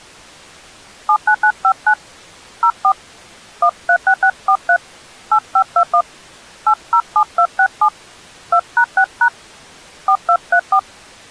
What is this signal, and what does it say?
DTMF, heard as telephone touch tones, dialled by hand, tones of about 70 ms. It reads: 79959 04 136643 8521 807267 2#6# 4234